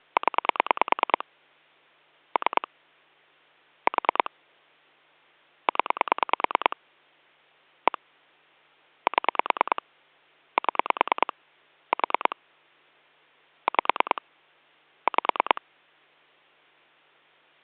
Pulse dialling, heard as clicks on a phone line, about 9 pulses a second. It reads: 0 3 4 0 1 7 7 4 5 5